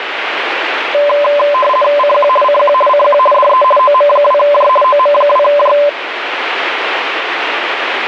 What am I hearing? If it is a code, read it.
RTTY (50 baud, 450 Hz shift), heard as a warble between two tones, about 800 Hz centre, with radio static. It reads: CQ CQ CQ DE OM2J OM2J